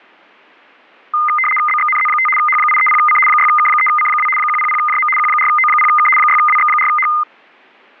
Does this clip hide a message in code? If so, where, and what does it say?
Yes: RTTY (75 baud, 850 Hz shift) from 1.1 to 7.2 s, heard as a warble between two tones, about 1650 Hz centre. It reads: BXNZ5 H830C 6K3C2 100JM Q4O0K 6WX4H